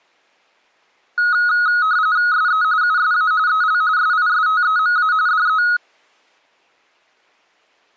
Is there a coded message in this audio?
Yes: RTTY (45.45 baud, 170 Hz shift) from 1.2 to 5.8 s, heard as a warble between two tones, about 1360 Hz centre. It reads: SE USA EL SISTEMA DE